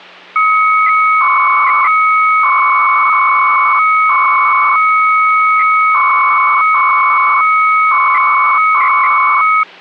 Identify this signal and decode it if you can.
300-baud modem data (Bell 103 tones), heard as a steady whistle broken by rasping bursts, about 300 baud, 200 Hz shift, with hum.